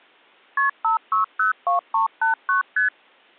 Multi-frequency trunk signalling (R1, as on North American trunks), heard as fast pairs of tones, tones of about 130 ms. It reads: KP 5602389 ST